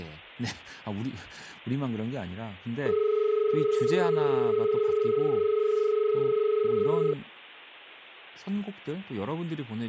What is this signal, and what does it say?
Telephone call progress tone (as in Australia), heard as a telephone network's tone, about 430 Hz, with speech in Korean. Dial tone.